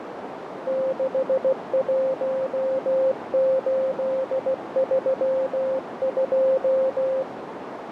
Morse code, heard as a keyed tone, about 16 wpm, 530 Hz, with radio static and a narrow filter. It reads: 61832